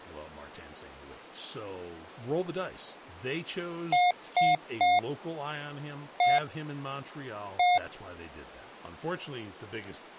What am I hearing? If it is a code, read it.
Beep code, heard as beeps from a small speaker, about 720 Hz, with speech in English. 3-1-1. In Phoenix BIOS tables: DMA register failure.